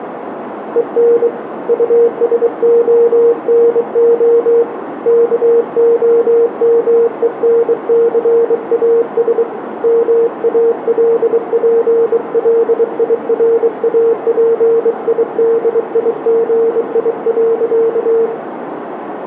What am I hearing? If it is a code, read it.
Morse code, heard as a keyed tone, hand-sent with a bug key, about 23 wpm, 460 Hz, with radio static, a narrow filter and room echo. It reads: EN USONO KOMENCAS MALPLIRAPIDIGI.